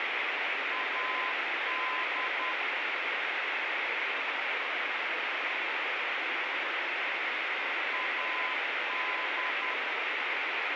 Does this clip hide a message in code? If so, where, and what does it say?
Yes: Morse code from 0.7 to 9.8 s, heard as a keyed tone, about 10 wpm, 1020 Hz, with radio hiss. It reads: AD AD